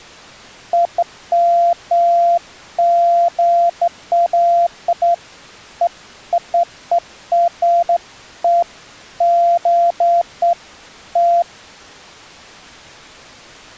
Beeps of irregular length. There is no code.